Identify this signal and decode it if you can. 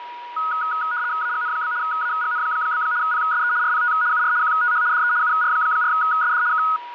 RTTY (75 baud, 170 Hz shift), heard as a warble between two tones, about 1360 Hz centre, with a steady whistle near 960 Hz. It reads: AGN? AGN? PSE RPT UR QTH DE UR4SD K